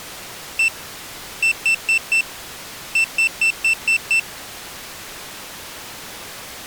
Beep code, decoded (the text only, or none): 1-4-6